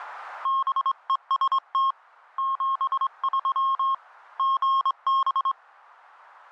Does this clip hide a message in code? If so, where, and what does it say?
Yes: Morse code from 0.4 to 5.6 s, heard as a keyed tone, hand-sent with a straight key, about 24 wpm, 1080 Hz. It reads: BEST 73 GB